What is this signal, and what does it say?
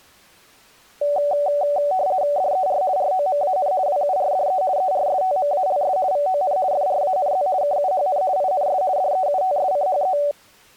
RTTY (50 baud, 170 Hz shift), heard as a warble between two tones, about 660 Hz centre. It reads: DER ROMAN WURDE ERSTMALS VON FRANZ KUHN INS DEUTSCHE